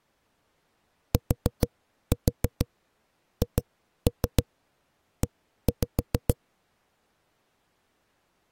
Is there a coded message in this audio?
Yes: tap code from 1.1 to 6.4 s, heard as knocks on a wall, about 6 knocks a second. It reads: THE